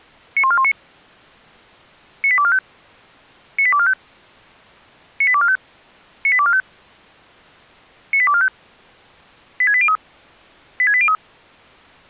Five-tone selective call (ZVEI), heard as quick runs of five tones, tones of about 70 ms. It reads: 91419 98245 98245 98245 98245 98245 86803 86803